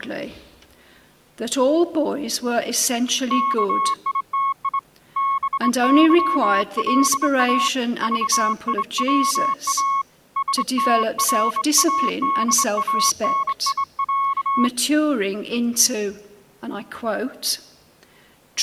Morse code (Russian alphabet), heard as a keyed tone, hand-sent with a straight key, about 24 wpm, 1100 Hz. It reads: КИТИ БЫЛА ЖИВА СТРАДАНИЯ